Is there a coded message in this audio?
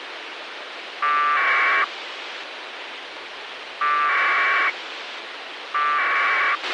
Yes: packet radio (AX.25, as in APRS), 1200 baud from 1.0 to 6.6 s, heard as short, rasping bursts, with radio hiss and a squelch burst at the end.